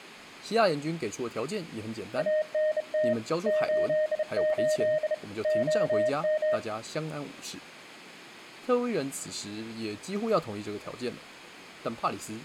Morse code, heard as a keyed tone, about 31 wpm, 620 Hz, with speech in Chinese. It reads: ANT 88 OM